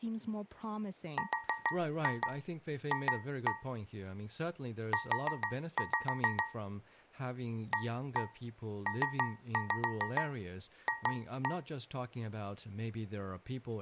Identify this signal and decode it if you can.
Tap code, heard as taps on a metal pipe, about 6 knocks a second, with speech in English. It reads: RF U APF